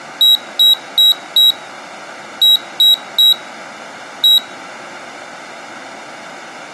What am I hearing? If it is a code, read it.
Beep code, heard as a piezo beeper, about 3850 Hz. 4-3-1. In Phoenix BIOS tables: memory failure above the first 64 KB.